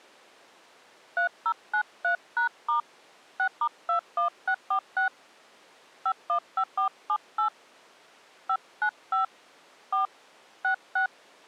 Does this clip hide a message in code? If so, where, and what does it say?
Yes: DTMF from 1.2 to 11.1 s, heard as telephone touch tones, dialled by hand, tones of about 100 ms. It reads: 3093#* 6*21646 515478 595 4 66